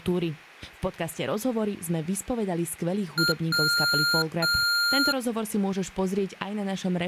Beep code, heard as beeps from a small speaker, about 1400 Hz, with room echo and speech in Slovak. 1 short, 2 long.